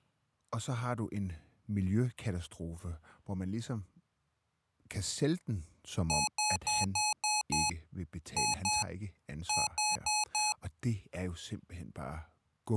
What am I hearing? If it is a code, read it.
Beep code, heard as beeps from a small speaker, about 850 Hz, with speech in Danish. 6-2-4.